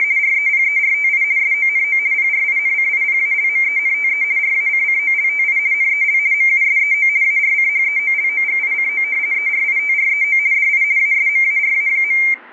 RTTY (50 baud, 170 Hz shift), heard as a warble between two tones, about 2200 Hz centre. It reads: … REPERTI SONO PRINCIPALMENTE RACCOLTI NEL MUSEO ARCHEOLOGICO ERITREO DI ASMARA.